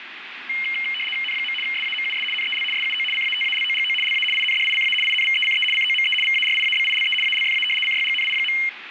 RTTY (75 baud, 850 Hz shift), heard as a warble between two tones, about 2550 Hz centre, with radio static. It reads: N. SAMUS NEL SUO CATALOGO LA INDICA INVECE COME VARIABILE ALFA CYGNI.